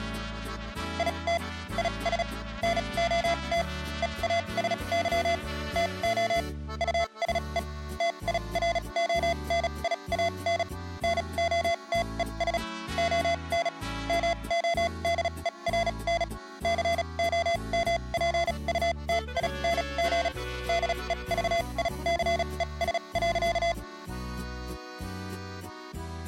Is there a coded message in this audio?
Yes: Morse code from 0.9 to 23.8 s, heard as electronic beeps, machine-sent, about 36 wpm, spaced as for 28 wpm, 680 Hz. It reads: IT IS NOT EASY TO USE TIRONIAN NOTES ON MODERN COMPUTING DEVICES.